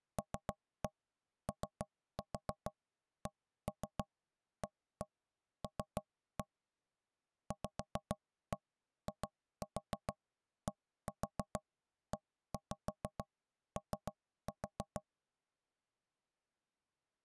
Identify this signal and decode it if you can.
Tap code, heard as knocks on wood, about 6 knocks a second. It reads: LOCAL VIDEO